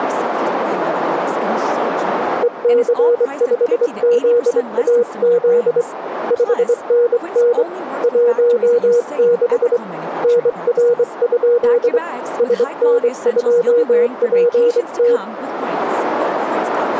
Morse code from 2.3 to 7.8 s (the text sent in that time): EC5ZAZ 5NN